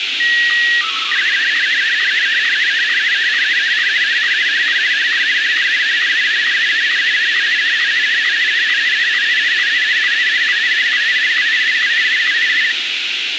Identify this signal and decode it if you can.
SSTV (slow-scan television), Martin M1, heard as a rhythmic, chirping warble, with radio hiss.